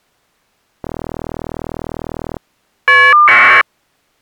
Caller ID data burst, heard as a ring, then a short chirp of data, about 1200 baud.